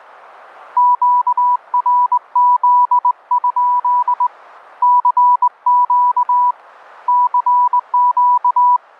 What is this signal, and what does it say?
Morse code, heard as a keyed tone, hand-sent with a straight key, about 20 wpm, 980 Hz. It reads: QRZ? CQ CQ